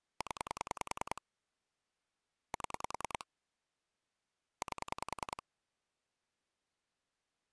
Pulse dialling, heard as clicks on a phone line, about 10 pulses a second. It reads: 0 7 8